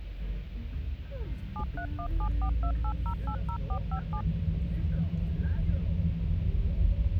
DTMF, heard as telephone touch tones, dialled by machine, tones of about 80 ms, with the noise inside a car. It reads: 7317428080457